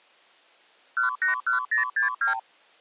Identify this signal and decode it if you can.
Multi-frequency trunk signalling (R2, with the far end's replies), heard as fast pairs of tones, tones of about 120 ms. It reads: 181062